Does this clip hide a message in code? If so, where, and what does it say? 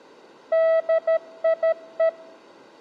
Yes: Morse code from 0.5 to 2.2 s, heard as a keyed tone, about 13 wpm, 650 Hz. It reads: DIE